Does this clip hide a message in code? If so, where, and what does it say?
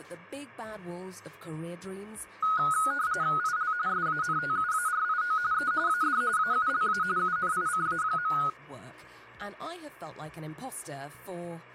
Yes: RTTY (45.45 baud, 170 Hz shift) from 2.4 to 8.5 s, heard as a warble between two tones, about 1360 Hz centre. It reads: IL SANTUARIO E AD AULA UNICA.